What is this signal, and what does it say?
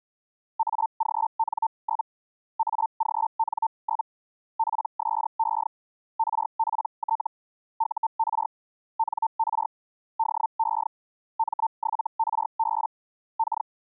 Hellschreiber (Feld-Hell, 122.5 baud), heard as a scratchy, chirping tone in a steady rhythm, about 900 Hz. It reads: AGN? AGN? PSE RPT UR NR DE M7RB K